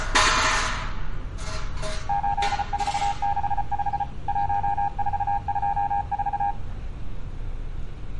Morse code, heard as a keyed tone, machine-sent, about 34 wpm, 810 Hz, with street noise. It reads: 8465 1424